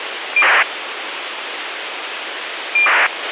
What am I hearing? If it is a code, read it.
ACARS aircraft data, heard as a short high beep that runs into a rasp, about 2400 baud, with radio hiss and a squelch burst at the end.